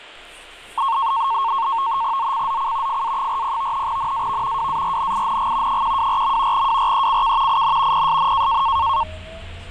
NAVTEX (SITOR-B), 100 baud, 170 Hz shift, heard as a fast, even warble, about 1000 Hz centre, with the noise inside a subway train. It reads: ZCZC FA40 NAV WARNING 124. WRECK IN PSN